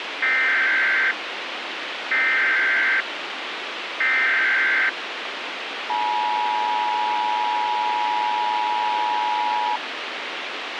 Emergency Alert System (SAME) tones (header bursts, then the 853 and 960 Hz attention tone), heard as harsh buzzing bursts, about 520.83 baud, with radio hiss and a squelch burst at the end.